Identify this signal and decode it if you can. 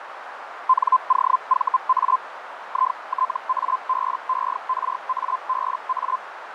Hellschreiber (Feld-Hell, 122.5 baud), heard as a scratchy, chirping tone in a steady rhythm, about 1030 Hz, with radio static and a narrow filter. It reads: NOVA ITABERABA